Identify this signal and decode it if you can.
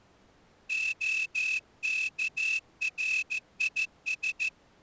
Morse code (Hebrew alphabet), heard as a whistle, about 14 wpm. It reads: הכריש